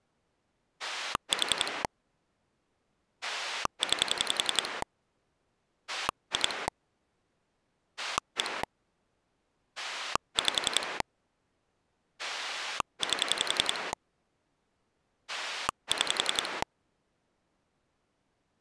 Pulse dialling, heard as a rotary dial, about 11 pulses a second. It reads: 4 9 2 1 5 8 6